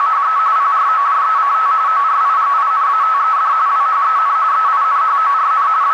RTTY (45.45 baud, 170 Hz shift), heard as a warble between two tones, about 1210 Hz centre, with radio static and a narrow filter. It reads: … PROJECT ORIGINATED WHEN EINHORN …